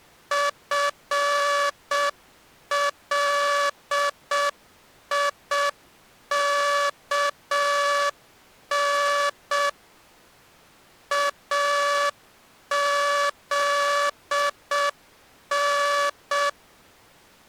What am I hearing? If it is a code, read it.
Morse code (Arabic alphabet), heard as a buzzer, machine-sent, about 6 wpm. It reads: فليكن اذن